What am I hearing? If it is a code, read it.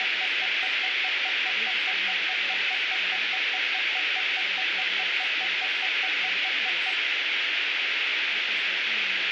Evenly repeated beeps, with radio static, room echo and speech in English. There is no code.